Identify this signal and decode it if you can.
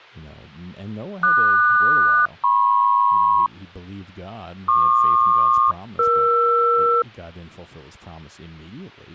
Aircraft SELCAL, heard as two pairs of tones, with speech in English. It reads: QS-MP PQ-ER